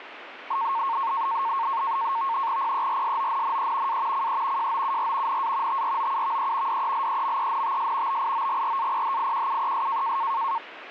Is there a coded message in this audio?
Yes: NAVTEX (SITOR-B), 100 baud, 170 Hz shift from 0.5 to 10.6 s, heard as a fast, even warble, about 1000 Hz centre, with radio static. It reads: PERSONNE A CE JOUR NA TROUVE DELEMENTS BIOGRAPHIQUES